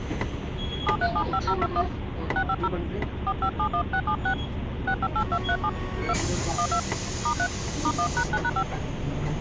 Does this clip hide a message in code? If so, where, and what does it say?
Yes: DTMF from 0.9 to 8.6 s, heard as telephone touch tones, dialled by hand, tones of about 70 ms, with the noise inside a bus. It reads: 7375021 650 4571676 658237 2 12 *3 *1#9#5